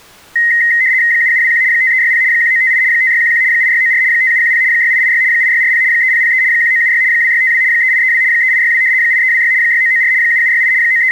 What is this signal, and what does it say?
RTTY (75 baud, 170 Hz shift), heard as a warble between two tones, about 1950 Hz centre. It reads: 7721 5360 1958 5611 8694 5710 6886 8640 3003 1976 2652 3832 3862 8326 6994 7768 …